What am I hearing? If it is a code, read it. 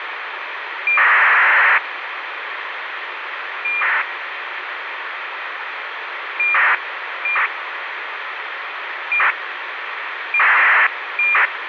ACARS aircraft data, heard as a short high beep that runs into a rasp, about 2400 baud, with radio hiss.